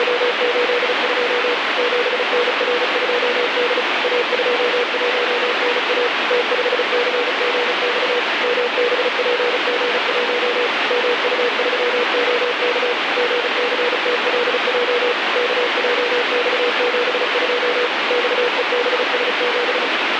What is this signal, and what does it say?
Morse code, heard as a keyed tone, machine-sent, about 35 wpm, 480 Hz, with heavy radio static. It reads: … 7NR2D A21NA T5CGX MBPG1 MU3OK GCTLJ KJX72 XEBS7